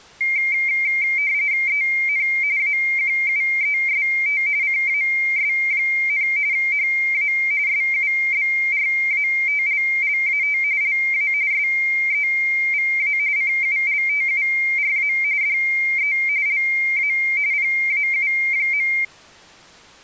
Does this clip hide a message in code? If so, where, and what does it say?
Yes: RTTY (45.45 baud, 170 Hz shift) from 0.2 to 19.0 s, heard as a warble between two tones, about 2200 Hz centre. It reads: EN AQUEST CAS, HA SUBRATLLAT LA SEVA CULTURA DE LA PAU.